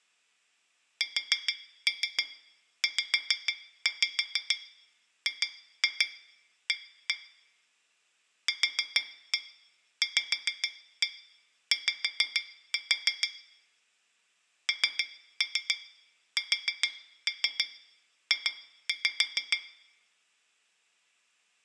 Tap code, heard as taps on glass, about 6 knocks a second, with room echo. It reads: SZGA QVY NSJ